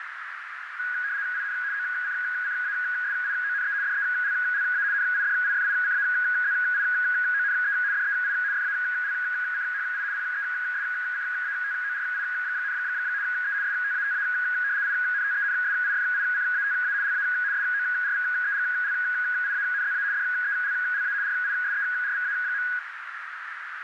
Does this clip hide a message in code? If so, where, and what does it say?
Yes: RTTY (75 baud, 170 Hz shift) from 0.8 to 22.8 s, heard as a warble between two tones, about 1550 Hz centre, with radio static and a narrow filter. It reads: IN OCCASIONE DELLA NIDIFICAZIONE DEI FALCHI PESCATORI, E STATA INTENSIFICATA LA SORVEGLIANZA DELLA RISERVA.